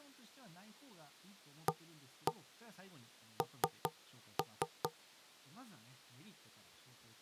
Tap code, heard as knocks on wood, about 4 knocks a second, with speech in Japanese. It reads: AN